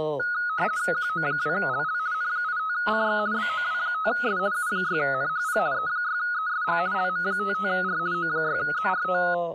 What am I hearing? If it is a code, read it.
RTTY (50 baud, 170 Hz shift), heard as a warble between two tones, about 1360 Hz centre, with speech in English. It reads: QO2LL N85CX BOW5S U6NHP E6ESG LM55R O6ZRT